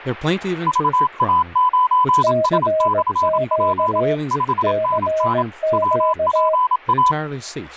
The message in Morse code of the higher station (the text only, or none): VA9S/P 5NN WPA